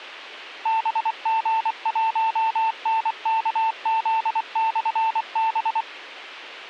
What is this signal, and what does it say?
Morse code, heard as a keyed tone, machine-sent, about 24 wpm, 890 Hz, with a squelch burst at the end. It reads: BG1NKZ/B